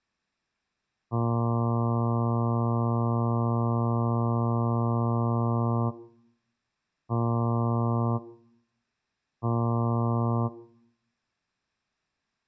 Ship horn signal, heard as a ship's horn, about 120 Hz. 1 long, 2 short. At sea: a vessel in fog that is sailing, fishing, towing or hampered.